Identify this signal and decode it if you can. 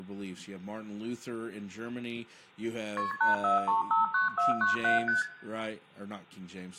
Multi-frequency trunk signalling (R1, as on North American trunks), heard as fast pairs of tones, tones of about 140 ms, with room echo and speech in English. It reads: KP 84359497 ST